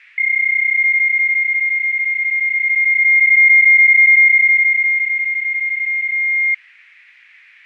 PSK31 (31.25 baud), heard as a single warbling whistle, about 2100 Hz, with fading.